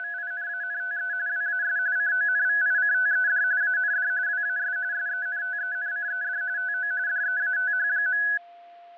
RTTY (45.45 baud, 170 Hz shift), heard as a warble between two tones, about 1600 Hz centre, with fading and a steady whistle near 690 Hz. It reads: … WAS CONVICTED AND WAS SENTENCED TO DEATH.